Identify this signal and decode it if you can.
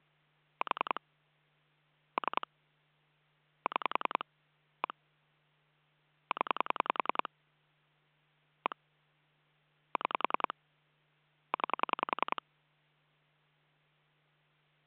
Pulse dialling, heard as clicks on a phone line, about 10 pulses a second. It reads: 4 3 6 1 0 1 6 9